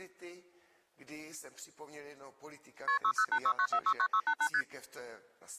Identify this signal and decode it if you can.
Multi-frequency trunk signalling (R1, as on North American trunks), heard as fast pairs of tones, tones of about 70 ms. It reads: KP 60869469688 ST